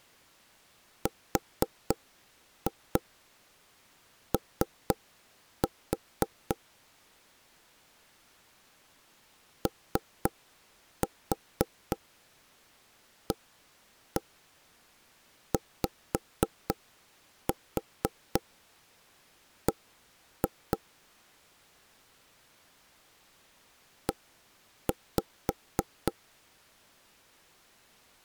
Tap code, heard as knocks on wood, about 3 knocks a second. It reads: RO OAYB E